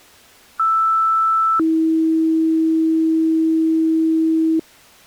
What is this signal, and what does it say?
Two-tone page, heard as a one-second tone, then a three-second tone, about 1320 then 320 Hz.